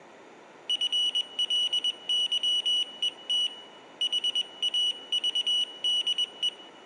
Morse code, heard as a high beeper, hand-sent with a paddle, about 21 wpm, 2950 Hz, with room echo. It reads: FLYET HAVDE